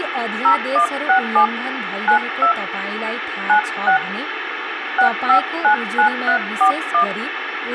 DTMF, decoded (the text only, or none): 0167 92 96 6599341